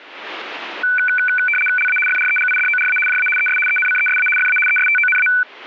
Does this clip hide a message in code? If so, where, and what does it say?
Yes: RTTY (75 baud, 850 Hz shift) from 0.8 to 5.4 s, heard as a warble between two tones, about 1900 Hz centre. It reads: LA FREGIDORA JA ES ENCESA FA ESTONA